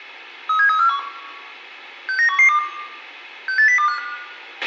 Five-tone selective call (CCIR), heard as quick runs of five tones, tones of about 100 ms, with a squelch burst at the end and room echo. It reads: 37341 69112 68025